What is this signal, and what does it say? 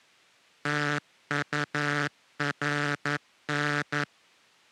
Morse code, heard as a buzzer, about 11 wpm. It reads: TURN